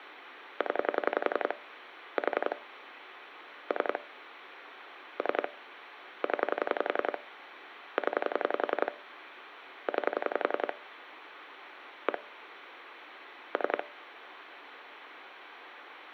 Pulse dialling, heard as clicks on a phone line, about 11 pulses a second, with phone line noise. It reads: 0 4 3 3 0 0 9 1 3